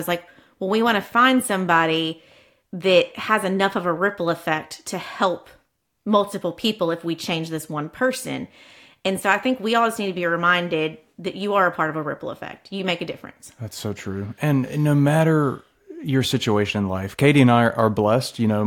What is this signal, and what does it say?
Speech in English. There is no code.